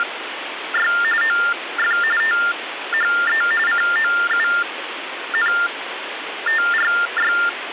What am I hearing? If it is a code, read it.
TTY/TDD text telephone tones (45.45 baud Baudot), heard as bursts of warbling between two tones, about 400 Hz shift, 1600 Hz centre, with phone line noise. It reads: … OF THE COUNTRY